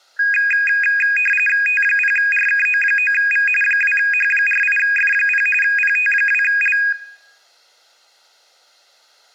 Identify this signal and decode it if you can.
RTTY (45.45 baud, 850 Hz shift), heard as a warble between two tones, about 2050 Hz centre. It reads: T0RKO9V 2H48F0 PT2L